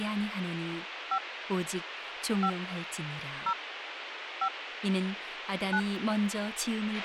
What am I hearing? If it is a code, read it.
DTMF, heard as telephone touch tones, dialled by hand, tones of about 70 ms, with radio hiss, a squelch burst at the end and speech in Korean. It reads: 5 5 0 5 9